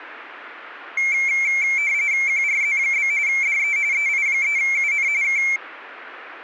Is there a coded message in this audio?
Yes: RTTY (45.45 baud, 170 Hz shift) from 1.0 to 5.6 s, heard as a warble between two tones, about 2250 Hz centre. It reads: QRZ? DE EI3UN K